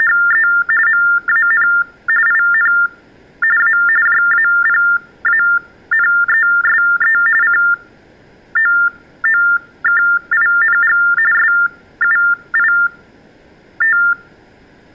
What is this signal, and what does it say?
TTY/TDD text telephone tones (45.45 baud Baudot), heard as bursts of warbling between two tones, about 400 Hz shift, 1600 Hz centre. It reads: … MAN IN A JAPANESE COOKING SUIT